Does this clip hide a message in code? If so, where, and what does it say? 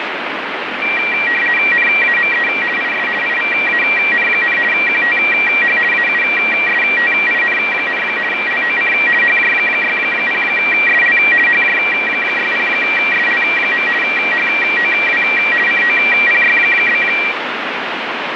Yes: RTTY (50 baud, 450 Hz shift) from 0.8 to 17.3 s, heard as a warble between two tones, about 2150 Hz centre, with radio static. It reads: NAME IS IVAN, QTH AUSTIN, LOC HJ60SL HJ60SL. HOW COPY?